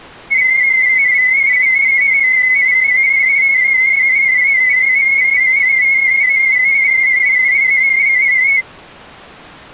Multi-tone FSK (Olivia or MFSK type), about 250 Hz wide, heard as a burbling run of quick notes, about 31.25 baud.